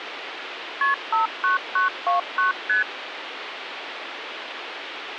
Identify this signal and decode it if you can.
Multi-frequency trunk signalling (R1, as on North American trunks), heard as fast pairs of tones, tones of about 130 ms, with phone line noise. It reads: KP 59929 ST